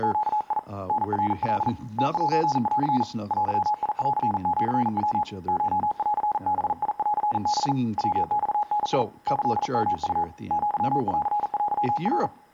Morse code (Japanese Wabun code), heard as a keyed tone, hand-sent with a paddle, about 40 wpm, 840 Hz, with room echo and speech in English. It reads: … タナカ ムセン デンシヤ コンバンハ ヤマダ キヨウ アンテナ